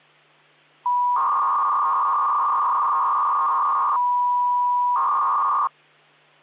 300-baud modem data (V.21 tones), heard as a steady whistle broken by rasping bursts, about 300 baud, 200 Hz shift, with hum.